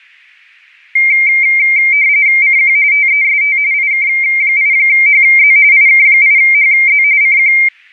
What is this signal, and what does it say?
RTTY (45.45 baud, 170 Hz shift), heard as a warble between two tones, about 2200 Hz centre. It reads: CQ TEST IK8HZ IK8HZ CQ